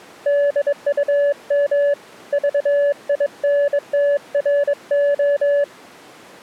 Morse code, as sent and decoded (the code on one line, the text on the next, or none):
-.. ..- -- / ...- .. -. - .-. ---
DUM VINTRO